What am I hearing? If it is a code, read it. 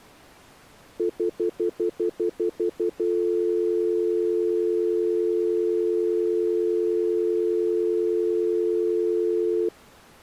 Telephone call progress tone (North American plan), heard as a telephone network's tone, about 350, 440 Hz, 0.1 s on and 0.1 s off. Stutter dial tone.